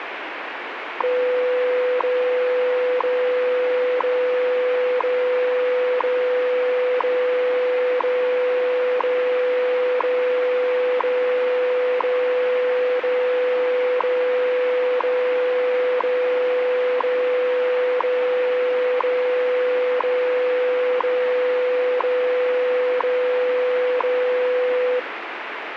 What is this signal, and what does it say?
Radio time signal (WWV, Colorado), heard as ticks, one a second, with radio static.